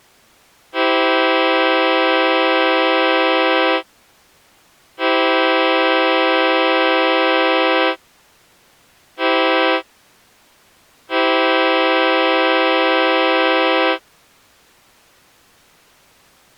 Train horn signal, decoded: 2 long, 1 short, 1 long

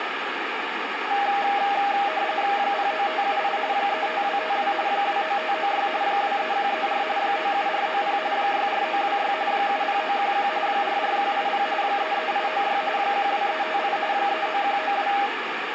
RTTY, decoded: 09578 35252 29596 23134 97490 64926 70911 44180 33896 12358 39192

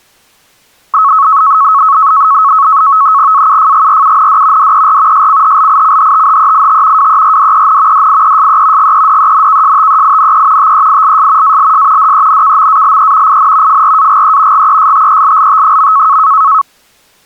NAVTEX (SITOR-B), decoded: AUFGRUND DER SCHLICHTHEIT WERDEN DIESE GEDENKSTEINE TEILS ALS DENKMALE IN FRAGE GESTELLT.

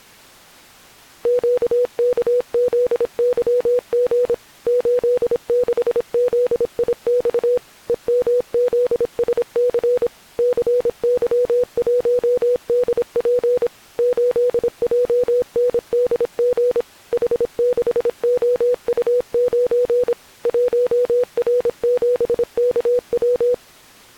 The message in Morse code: QKZYG 86ZIX EMZSC CY1DP 8JNDG H6OU9 1R7KW

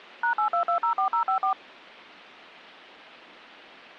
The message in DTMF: #82204054

